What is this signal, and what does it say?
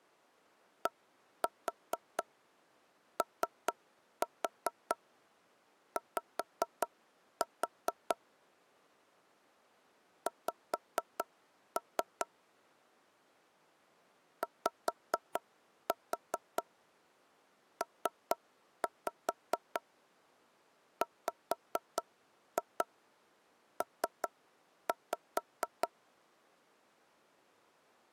Tap code, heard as knocks on wood, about 4 knocks a second. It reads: DOY X YPWP